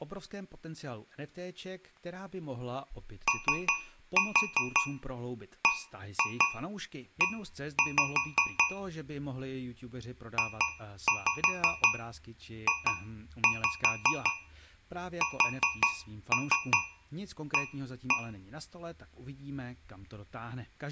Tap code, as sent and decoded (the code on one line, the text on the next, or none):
3-4 1-2 1-5 / 2-5 2-5 4-3 1-1
OBE JJSA